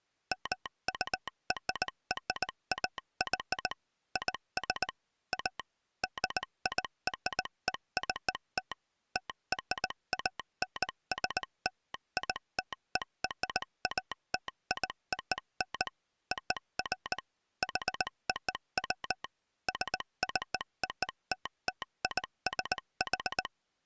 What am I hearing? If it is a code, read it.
Morse code (American railroad code), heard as a telegraph sounder, machine-sent. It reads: MURRAY IS A DIRECT TRANSLITERATION OF HOW SCOTTISH